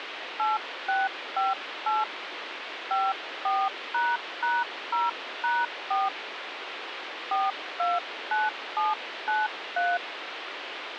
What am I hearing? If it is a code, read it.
DTMF, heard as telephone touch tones, dialled by hand, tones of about 200 ms, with phone line noise. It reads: 8658 54##0#4 429793